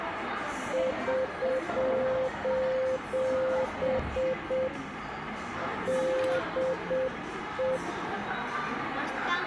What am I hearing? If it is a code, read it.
Morse code, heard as a keyed tone, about 7 wpm, 520 Hz, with radio static and the noise of a crowd indoors. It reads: <SOS> DE